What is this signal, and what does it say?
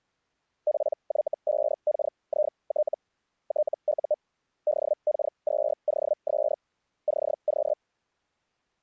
Hellschreiber (Feld-Hell, 122.5 baud), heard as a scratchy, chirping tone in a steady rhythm, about 600 Hz. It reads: PY5KIT TU DK2OS CQ